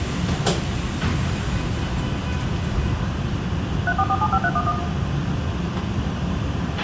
DTMF, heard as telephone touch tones, dialled by machine, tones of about 60 ms, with radio hiss, a squelch burst at the end, room echo and the noise inside a subway train. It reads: 34475311